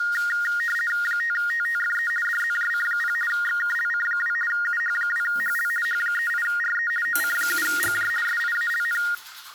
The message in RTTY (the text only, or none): 5TTFE DZJC0 XKLC2 UH2HL H38RE OC7GJ SIALN